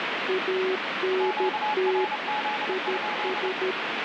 Morse code, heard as two keyed tones, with heavy radio static. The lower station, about 13 wpm, 380 Hz: ANT IS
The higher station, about 29 wpm, 840 Hz: QRZ?